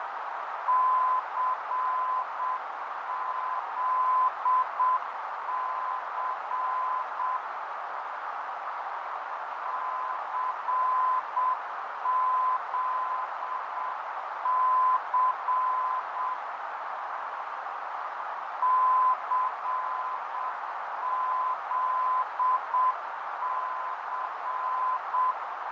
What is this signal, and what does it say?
Morse code, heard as a keyed tone, machine-sent, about 7 wpm, 1020 Hz, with heavy radio static, fading and a narrow filter. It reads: CZC CZC CZC